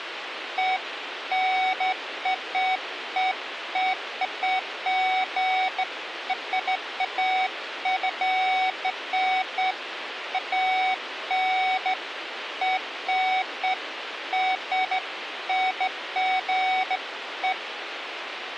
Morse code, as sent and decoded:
none

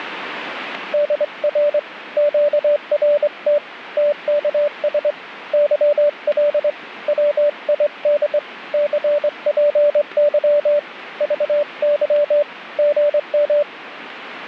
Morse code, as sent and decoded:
-.. .-. / --.- .-. - / - -.- ... / -.-- .-.. / .-- .. -.. / -.-. .--. -.-- / ...- -.-- / --. --
DR QRT TKS YL WID CPY VY GM

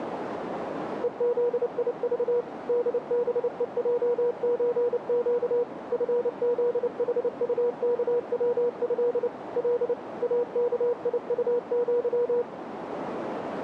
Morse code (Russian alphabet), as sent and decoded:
. --.. .. ...- / -.. -... . .--- ---. --.- / ..-. --.. .... ..- -.- .-- ..-.. / .-.. / .- -.- .. ..- --.--
ЕЗИЖ ДБЕЙЧЩ ФЗХУКВЭ Л АКИУЪ

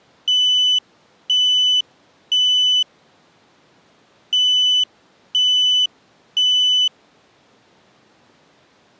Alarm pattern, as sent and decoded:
3 beeps and a pause
temporal three

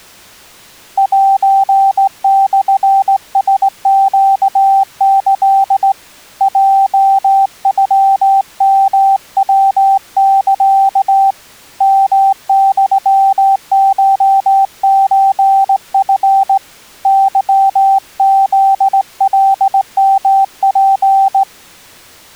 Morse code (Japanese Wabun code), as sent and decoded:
.---. -..-. ... --.- -.-.. / .--- ..-- -- .-- -.-.- / -- -..-- ---- ---. ..-. / -.-- --.. .-.. -- .--.
セモラネキ ヲノヨヤサ ヨユコソチ ケフカヨツ

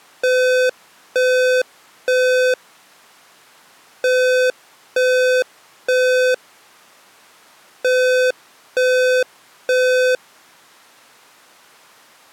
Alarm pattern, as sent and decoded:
3 beeps and a pause
temporal three

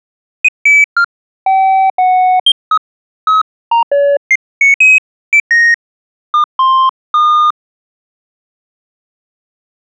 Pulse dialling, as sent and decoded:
none

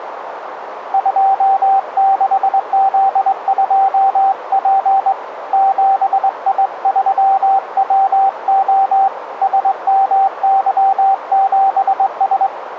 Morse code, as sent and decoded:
..--- -.... --.. ..--- .--. / --... .. ...-- .-- --- / ... -- -.-- --... ...
26Z2P 7I3WO SMY7S

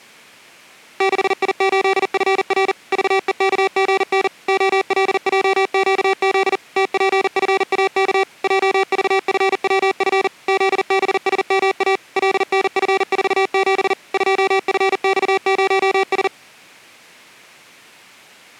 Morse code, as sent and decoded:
-.... .. ---.. ..-. .-. / ...- . -.- --. -. / --- .-.. .--- --.- --.. / - .--. ..-. .- -.- / .--- ...- ..-. .-- ..-. / --.. -... ... -- .- / .-.. -. ..-. ....- --... / ..--- ..-. -..- ----- ...
6I8FR VEKGN OLJQZ TPFAK JVFWF ZBSMA LNF47 2FX0S

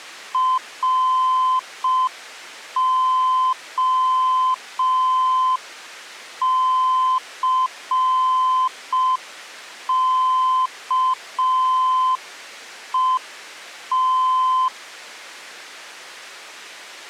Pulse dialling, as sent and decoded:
none

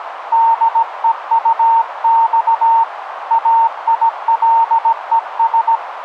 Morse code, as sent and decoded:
-.. . ..- -..- / .- .. .-.. . ...
DEUX AILES

